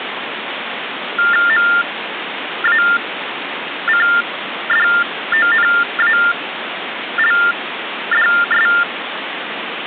TTY/TDD text telephone tones (45.45 baud Baudot), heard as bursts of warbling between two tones, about 400 Hz shift, 1600 Hz centre, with phone line noise. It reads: MACDONALDS